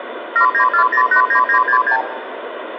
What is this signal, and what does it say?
Multi-frequency trunk signalling (R2, with the far end's replies), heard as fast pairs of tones, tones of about 90 ms, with phone line noise and room echo. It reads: 794089966